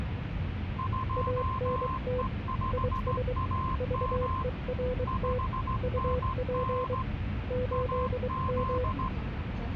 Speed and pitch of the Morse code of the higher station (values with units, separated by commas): 16 wpm, 1040 Hz